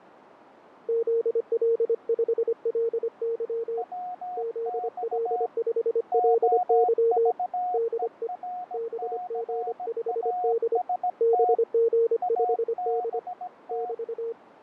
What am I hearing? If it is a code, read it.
Morse code, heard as two keyed tones, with radio static and fading. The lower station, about 25 wpm, 460 Hz: ZL5LY ZL5LY DE BG5D BG5D <BT>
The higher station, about 17 wpm, 720 Hz: WX OVERCAST ABT